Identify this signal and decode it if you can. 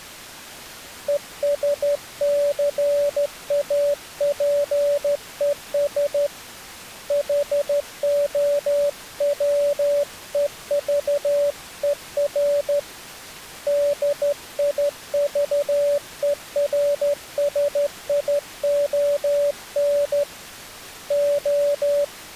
Morse code, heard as a keyed tone, hand-sent with a straight key, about 13 wpm, 580 Hz. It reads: ESCAPES HOWEVER DIVERSION …